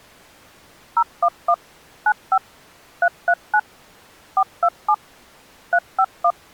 DTMF, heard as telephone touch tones, dialled by machine, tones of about 60 ms. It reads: 011 95 339 427 351